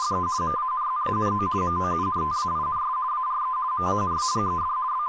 RTTY (50 baud, 170 Hz shift), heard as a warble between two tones, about 1120 Hz centre, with speech in English. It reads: … MANZANO MOUNTAINS ARE MANAGED …